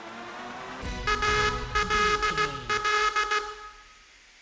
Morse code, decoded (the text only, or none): ALL